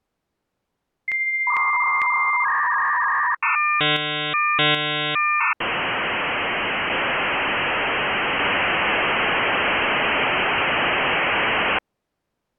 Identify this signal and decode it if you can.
Dial-up modem handshake (V.34 or later), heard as a whistle, warbles, then hiss.